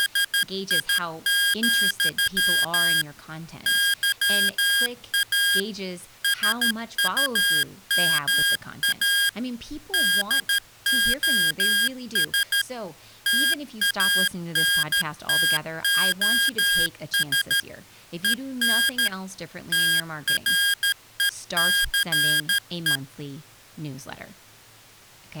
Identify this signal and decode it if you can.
Morse code, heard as electronic beeps, machine-sent, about 13 wpm, 1600 Hz, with speech in English. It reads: … YA SUMA DOS TANTOS EN TRECE